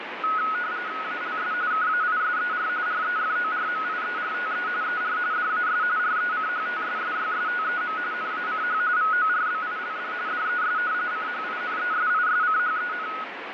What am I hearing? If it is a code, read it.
RTTY (45.45 baud, 170 Hz shift), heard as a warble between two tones, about 1370 Hz centre, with radio static. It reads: ALS KAISER REFORMIERTE ER DAS RECHTSSYSTEM NACH VORBILD DES CHINESISCHEN